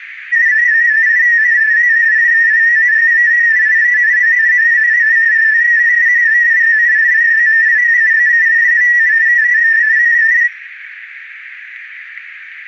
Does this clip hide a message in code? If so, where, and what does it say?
Yes: multi-tone FSK (Olivia or MFSK type), about 250 Hz wide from 0.3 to 10.5 s, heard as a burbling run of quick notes, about 31.25 baud, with radio static.